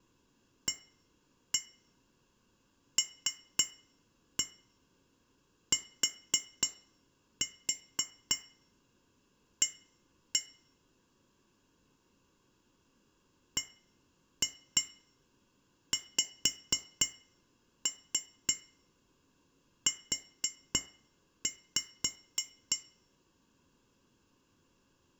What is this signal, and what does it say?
Tap code, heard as taps on glass, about 3 knocks a second, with room echo. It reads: ALTA BXU